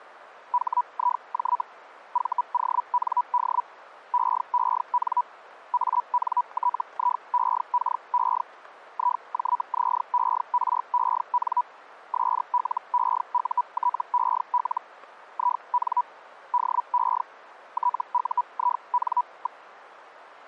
Hellschreiber (Feld-Hell, 122.5 baud), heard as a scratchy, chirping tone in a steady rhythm, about 980 Hz. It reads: HIJ VOND EEN ANTIEKE IJZEREN SLEUTEL IN DE TUIN.